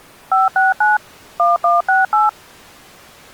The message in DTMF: 569 1168

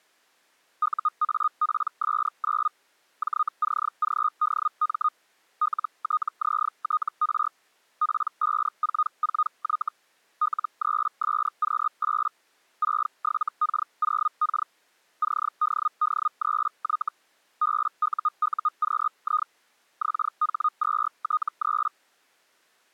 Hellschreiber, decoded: UAPS9 JCGDM LTZTR P544Y L3SQ8 67K0K CDD3Y BUUQI XH2T3

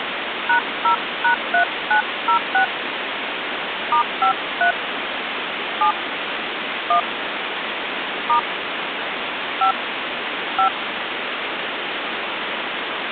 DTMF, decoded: #0#3906 *53 7 1 * 5 5

